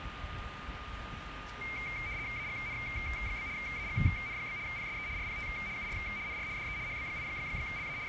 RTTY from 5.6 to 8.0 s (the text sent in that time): UR NR DE HB8LA …